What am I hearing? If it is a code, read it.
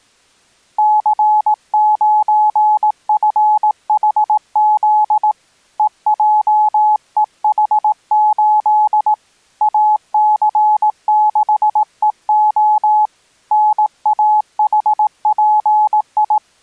Morse code, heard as a keyed tone, hand-sent with a paddle, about 18 wpm, 850 Hz. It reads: C9FHZ EJEH8 AC6EO NAHPI